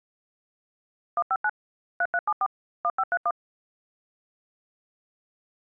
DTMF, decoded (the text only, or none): 159 3374 1531